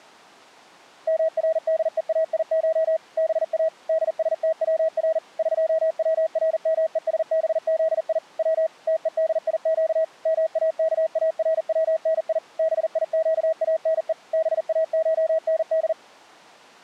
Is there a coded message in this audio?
Yes: Morse code (Persian alphabet) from 1.0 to 16.0 s, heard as a keyed tone, machine-sent, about 40 wpm, 640 Hz. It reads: مردهایش با دستور قورمهسبزی و تهدیگ ماکارونی بیگانه باشند